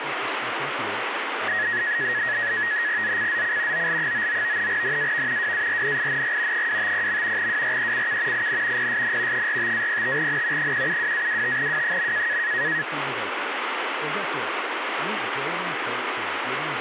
NAVTEX (SITOR-B), 100 baud, 170 Hz shift, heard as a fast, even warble, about 1800 Hz centre, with radio static and speech in English. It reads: ZCZC OL99 NAV WARNING 250. WRECK IN PSN 45-05N 172-25W.